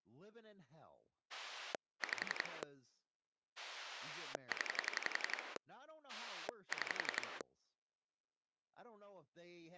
Pulse dialling, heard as a rotary dial, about 11 pulses a second, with speech in English. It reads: 5 0 6